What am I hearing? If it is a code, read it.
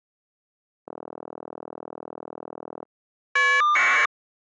Caller ID data burst, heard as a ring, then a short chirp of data, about 1200 baud.